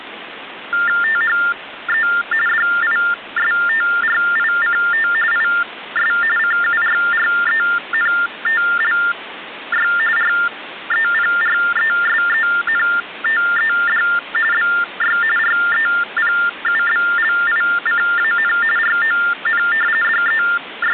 TTY/TDD text telephone tones (45.45 baud Baudot), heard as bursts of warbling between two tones, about 400 Hz shift, 1600 Hz centre, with phone line noise. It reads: THE DISTRICT IS CURRENTLY REPRESENTED BY REPUBLICAN RON …